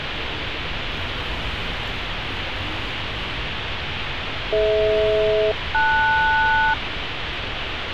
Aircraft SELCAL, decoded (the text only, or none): DH-LS